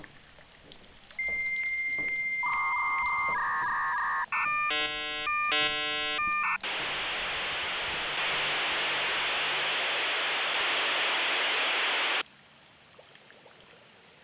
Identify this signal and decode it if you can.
Dial-up modem handshake (V.34 or later), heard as a whistle, warbles, then hiss.